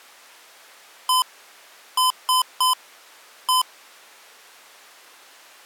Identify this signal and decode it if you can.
Beep code, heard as beeps from a small speaker, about 1020 Hz. 1-3-1. In Phoenix BIOS tables: memory refresh failure.